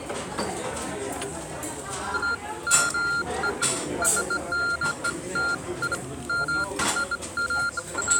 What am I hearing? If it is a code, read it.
Beeps of irregular length, with the noise of a restaurant. There is no code.